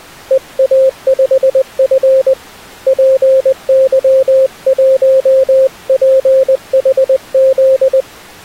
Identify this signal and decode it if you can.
Morse code, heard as a keyed tone, hand-sent with a paddle, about 20 wpm, 530 Hz. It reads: EA5F PY1PHZ